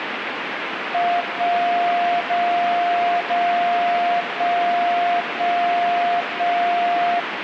Radio time signal (DCF77), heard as a tone whose level steps once a second, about 700 Hz, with radio static. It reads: 1 0 0 1 1 1